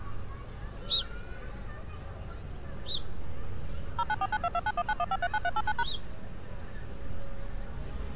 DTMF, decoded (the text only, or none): 0949229191539389#